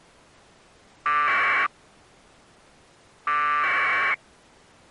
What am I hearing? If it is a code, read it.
Packet radio (AX.25, as in APRS), 1200 baud, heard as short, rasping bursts.